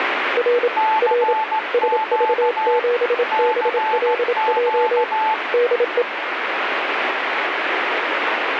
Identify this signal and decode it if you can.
Morse code, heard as two keyed tones, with radio static. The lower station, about 27 wpm, 480 Hz: R R SV7BLJ DE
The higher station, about 16 wpm, 870 Hz: CQ CQ